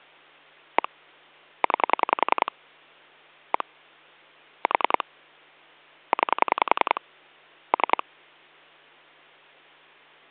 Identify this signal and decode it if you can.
Pulse dialling, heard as clicks on a phone line, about 10 pulses a second. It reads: 1 9 1 4 9 3